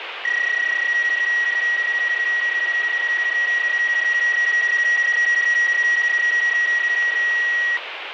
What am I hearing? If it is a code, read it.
PSK31 (31.25 baud), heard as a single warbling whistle, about 1900 Hz, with radio static.